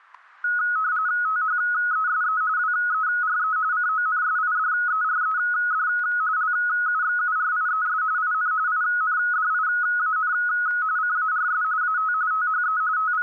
RTTY (45.45 baud, 170 Hz shift), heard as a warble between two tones, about 1360 Hz centre, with static crashes. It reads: THESE WERE CONSIDERED LUXURIES IN INDIAN CARS AT THE …